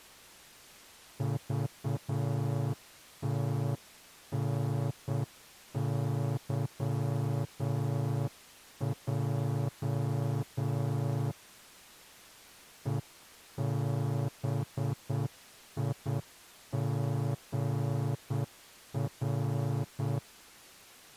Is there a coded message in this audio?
Yes: Morse code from 1.1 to 20.2 s, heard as a horn, hand-sent with a straight key, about 8 wpm. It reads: VTNYJ EBIGR